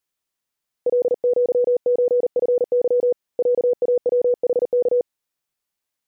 Morse code (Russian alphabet), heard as a keyed tone, hand-sent with a paddle, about 39 wpm, 490 Hz. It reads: ЛЪЧФЫ ЯАВХК